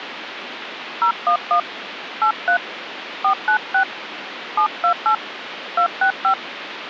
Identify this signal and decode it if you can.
DTMF, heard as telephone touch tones, dialled by hand, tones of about 90 ms, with phone line noise. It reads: 011 83 496 728 265